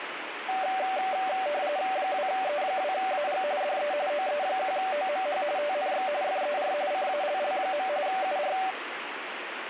RTTY (45.45 baud, 170 Hz shift), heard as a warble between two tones, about 670 Hz centre, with radio static. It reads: 2E2AG DE OE1OMH TNX FER CALL. UR